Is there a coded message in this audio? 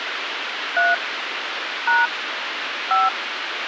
Yes: DTMF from 0.8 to 3.1 s, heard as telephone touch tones, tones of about 180 ms, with radio hiss. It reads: 3 # 5